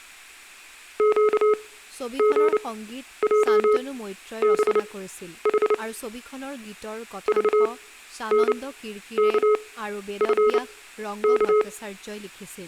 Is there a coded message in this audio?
Yes: Morse code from 0.9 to 11.7 s, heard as a keyed tone, machine-sent, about 29 wpm, spaced as for 11 wpm, 420 Hz, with speech in Assamese. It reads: QGJBH VNKFK